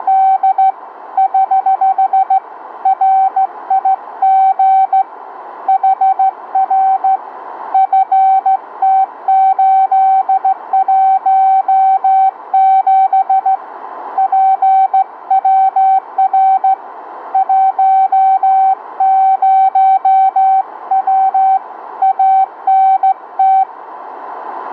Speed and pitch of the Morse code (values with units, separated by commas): 15 wpm, 770 Hz